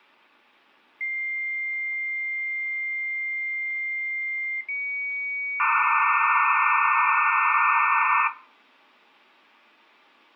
Dial-up modem handshake (low-speed, two carriers), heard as two whistles, then hiss, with room echo.